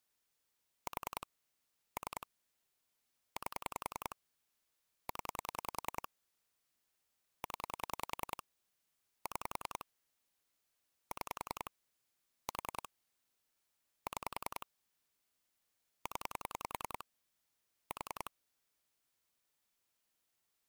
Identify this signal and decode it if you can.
Pulse dialling, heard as clicks on a phone line, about 10 pulses a second. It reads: 4 3 8 0 0 6 6 4 6 0 4